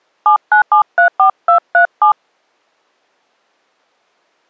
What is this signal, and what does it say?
DTMF, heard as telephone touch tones, dialled by hand, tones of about 100 ms. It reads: 79734237